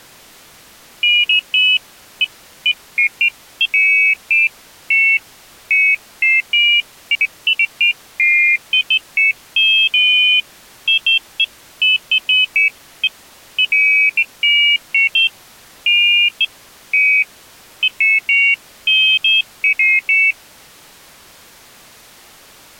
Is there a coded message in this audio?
No, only pairs of high tones at irregular times.